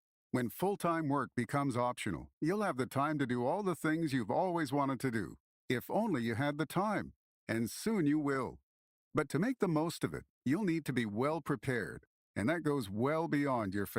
Speech in English. There is no code.